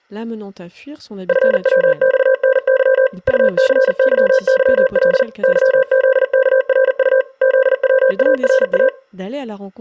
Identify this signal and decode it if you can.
Morse code, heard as a keyed tone, machine-sent, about 40 wpm, 520 Hz, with speech in French. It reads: FWXNY UCYYL YZKRU ZWARA